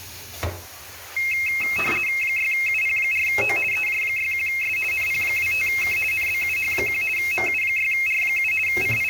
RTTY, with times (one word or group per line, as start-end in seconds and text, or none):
2.2-3.6 6UP4O
3.7-4.8 EJ61S
4.9-6.0 NP25K
6.1-7.0 NBUH1
7.2-8.5 MU6R7
8.7-9.1 …